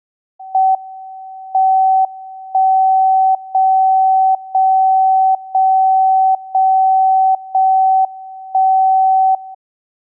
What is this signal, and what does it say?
Radio time signal (JJY), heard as a tone whose level steps once a second, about 760 Hz. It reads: M 1 0 0 0 0 0 1 0